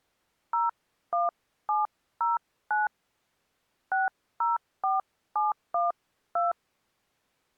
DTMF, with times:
0.5-2.9 01709
3.9-6.5 604712

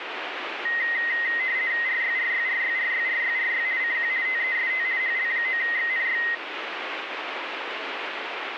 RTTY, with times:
1.9-3.7 RYRYRYRYRYRY
3.8-4.1 CQ
4.3-4.9 TEST
5.0-6.2 HL9XNY

